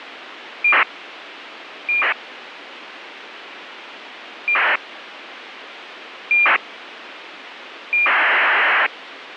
ACARS aircraft data, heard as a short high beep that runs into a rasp, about 2400 baud, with radio hiss.